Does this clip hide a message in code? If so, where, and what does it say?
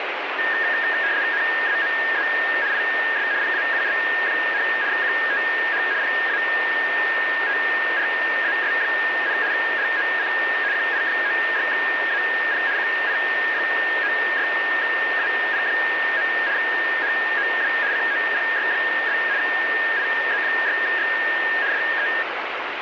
Yes: RTTY (75 baud, 170 Hz shift) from 0.4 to 22.2 s, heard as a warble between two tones, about 1750 Hz centre, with radio static. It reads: NAME IS PAUL, QTH PATRAS, LOC QI96AP QI96AP. HOW COPY? IZ6X DE